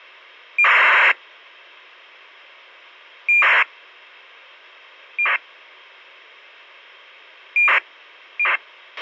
ACARS aircraft data, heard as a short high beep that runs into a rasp, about 2400 baud, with a squelch burst at the end.